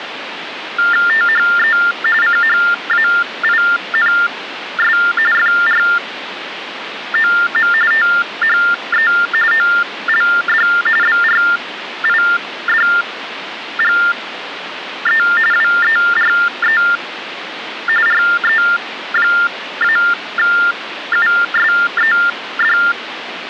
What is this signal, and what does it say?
TTY/TDD text telephone tones (45.45 baud Baudot), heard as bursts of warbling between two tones, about 400 Hz shift, 1600 Hz centre, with phone line noise. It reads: THE CHAINS FROM THE OLD BRIDGE WERE RE-USED